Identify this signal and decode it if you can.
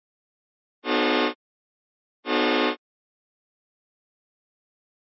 Train horn signal, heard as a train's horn. 2 short. On North American railways: a signal is acknowledged.